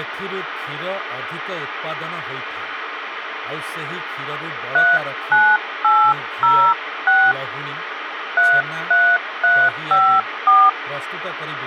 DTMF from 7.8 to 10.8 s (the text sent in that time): 33354